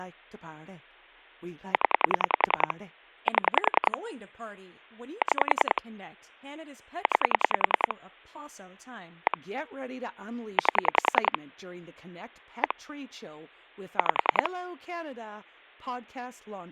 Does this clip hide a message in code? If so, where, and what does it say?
Yes: pulse dialling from 1.7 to 14.5 s, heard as clicks on a phone line, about 10 pulses a second, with speech in English. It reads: 0 7 6 9 1 8 1 5